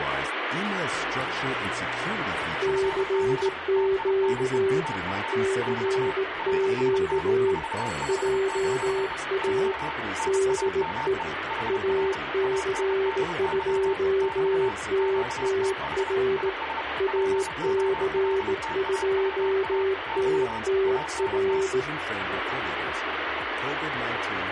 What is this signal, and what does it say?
Morse code, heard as two keyed tones, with radio static. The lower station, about 18 wpm, 390 Hz: CQ CQ JA DE AC2TTR AC2TTR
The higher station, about 31 wpm, 900 Hz: FB TINE TU <BT> RST 459 <BT> NAME HR ANDY <BT> QTH IS POLTAVA <BT> ANT